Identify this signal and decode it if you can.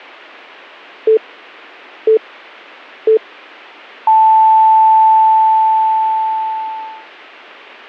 Radio time signal (three low pips and a long one an octave up, as on NHK), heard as pips.